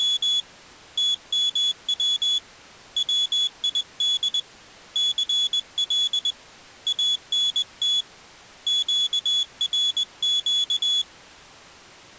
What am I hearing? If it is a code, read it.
Morse code, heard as a high beeper, hand-sent with a straight key, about 20 wpm, 3400 Hz. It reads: … TMW WID CL ANT QRQ